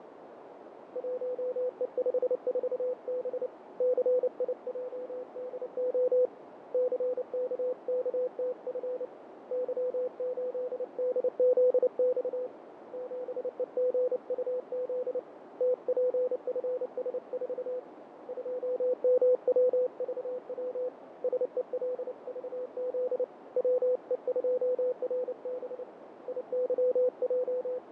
Morse code, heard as a keyed tone, hand-sent with a paddle, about 29 wpm, 500 Hz, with radio static, fading and a narrow filter. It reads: 1E54B CIJDO CKKTF Y8DZX 7EGUZ TPFS4 2MWVW SELVZ WE2RB …